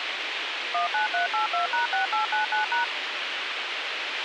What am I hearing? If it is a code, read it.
DTMF, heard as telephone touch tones, dialled by machine, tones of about 130 ms, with radio hiss, a squelch burst at the end and speech in Goan Konkani. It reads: 19382#6899#